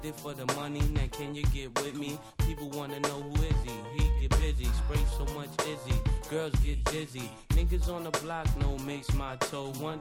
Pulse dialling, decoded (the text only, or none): none